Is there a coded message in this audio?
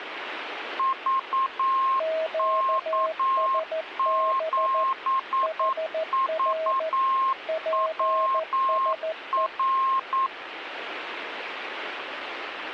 Yes: Morse code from 0.7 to 10.3 s, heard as two keyed tones, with radio static. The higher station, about 9 wpm, 1060 Hz: VK7VWR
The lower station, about 14 wpm, 640 Hz: QSB HR PSE